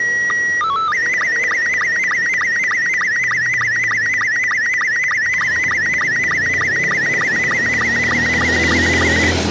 SSTV (slow-scan television), Robot 72, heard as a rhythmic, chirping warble, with the noise of a residential street.